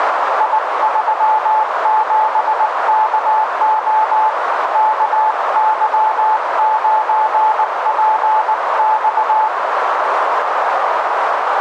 Morse code, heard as a keyed tone, hand-sent with a paddle, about 19 wpm, 870 Hz, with radio static and a narrow filter. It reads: I37KO KY9PX